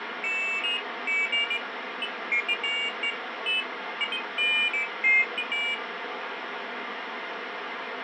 Pairs of high tones at irregular times, with phone line noise. There is no code.